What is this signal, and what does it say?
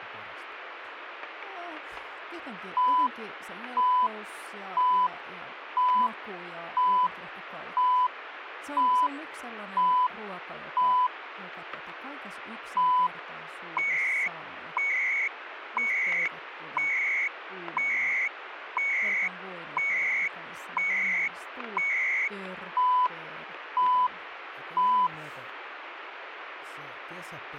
Radio time signal (CHU, Canada), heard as beeps and data bursts, one a second, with radio static and speech in Finnish.